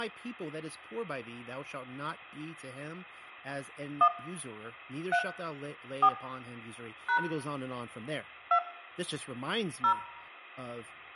DTMF, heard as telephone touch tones, dialled by hand, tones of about 80 ms, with room echo and speech in English. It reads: 1 3 4 # 2 0